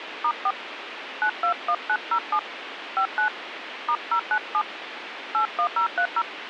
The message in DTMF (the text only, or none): *4 921907 59 *097 81030